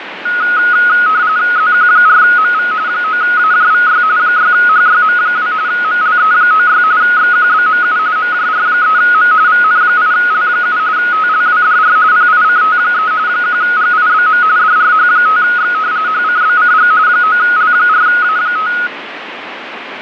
RTTY (45.45 baud, 170 Hz shift), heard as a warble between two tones, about 1360 Hz centre, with radio static and fading. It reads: ZQ4MV 9AJVY 6HYM2 MLE96 XQBMU MJR3M VN8L7 TLWDR PICT3 1GIBM DRH5X HCBCG 9L4A5